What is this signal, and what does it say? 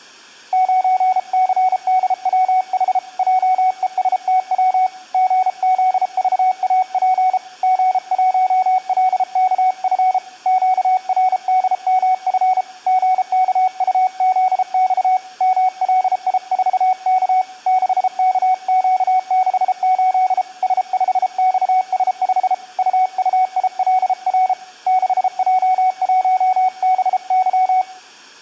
Morse code, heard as a keyed tone, hand-sent with a paddle, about 33 wpm, 750 Hz, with room echo. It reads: 9CDWH JESTW GZVAP G1LKF QRDMF GKUZX MLI4K 6KQ68 S5XS5 UUILR 6J1BY